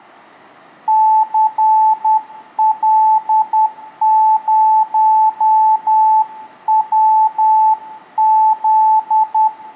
Morse code, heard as a keyed tone, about 10 wpm, 870 Hz, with room echo. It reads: CL0WZ